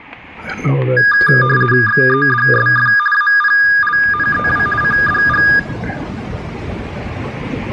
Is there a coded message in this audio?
Yes: RTTY (50 baud, 450 Hz shift) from 1.0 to 5.6 s, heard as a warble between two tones, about 1430 Hz centre, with static crashes and room echo. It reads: XEDSF APLNEW CDG